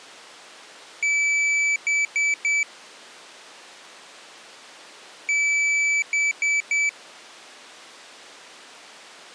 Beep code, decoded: 1 long, 3 short

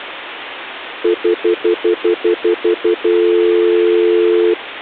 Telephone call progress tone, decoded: stutter dial tone

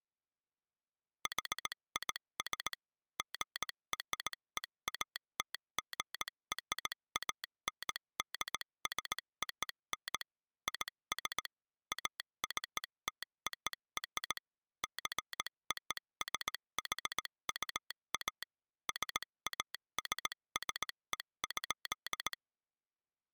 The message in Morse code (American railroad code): HIS GREATGRANDSON IS ACTOR JOSHUA SASSE.

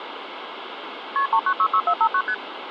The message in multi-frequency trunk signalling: KP 3966459 ST

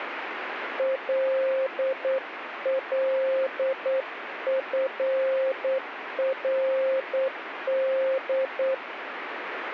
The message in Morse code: LLFRD

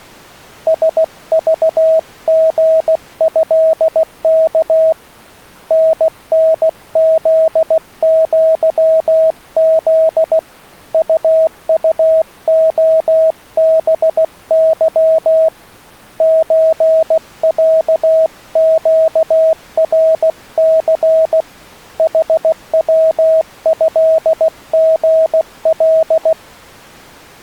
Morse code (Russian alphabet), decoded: СЖГЭК ННЗЪЗ УУОБЫ ЧЯЩРЦ ХВЭГЛ

